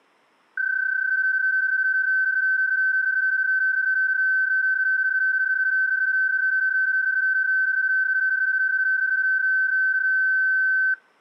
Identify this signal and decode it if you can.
PSK31 (31.25 baud), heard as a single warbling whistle, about 1550 Hz.